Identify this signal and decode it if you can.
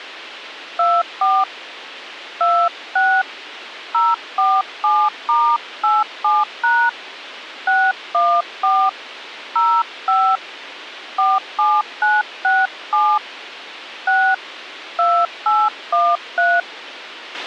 DTMF, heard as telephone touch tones, dialled by hand, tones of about 240 ms, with a squelch burst at the end. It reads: 24 26 047*87# 614 05 47967 6 2813